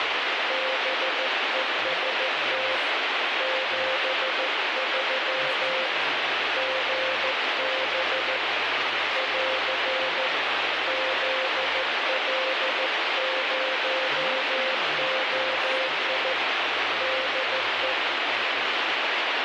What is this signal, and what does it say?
Morse code, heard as a keyed tone, hand-sent with a straight key, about 14 wpm, 520 Hz, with heavy radio static and speech in English. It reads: BEST 73 GB <AR> ZL0OI DE